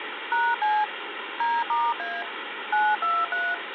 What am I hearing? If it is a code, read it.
DTMF, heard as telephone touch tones, dialled by machine, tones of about 220 ms, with phone line noise. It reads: #C D*A 923